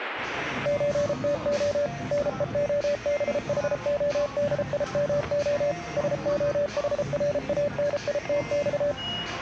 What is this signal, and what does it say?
Morse code (Russian alphabet), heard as a keyed tone, machine-sent, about 33 wpm, 580 Hz, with static crashes and the noise of a crowd indoors. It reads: ЧТО НЕОБХОДИМО СОХРАНИТЬ